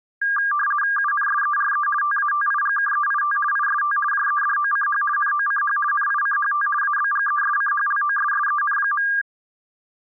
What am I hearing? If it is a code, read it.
RTTY (50 baud, 450 Hz shift), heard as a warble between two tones, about 1400 Hz centre. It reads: UNSERE TATIGKEIT IST JEDOCH NOCH NICHT ABGESCHLOSSEN.